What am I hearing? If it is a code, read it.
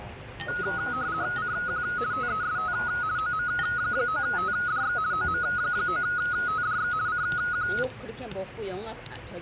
RTTY (50 baud, 170 Hz shift), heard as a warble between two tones, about 1360 Hz centre, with radio static and the noise of a restaurant. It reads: CQ TEST OM9TDX OM9TDX CQ